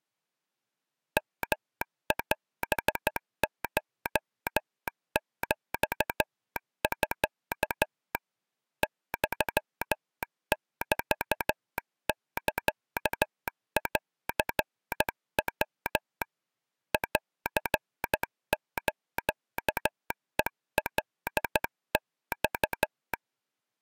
Morse code (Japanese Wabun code), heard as a telegraph sounder, hand-sent with a straight key, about 13 wpm. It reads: ヨオコヒミ ユメサンヤ ンスヘカマ